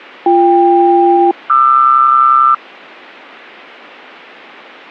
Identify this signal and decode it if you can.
Aircraft SELCAL, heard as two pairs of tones. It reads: BK-QR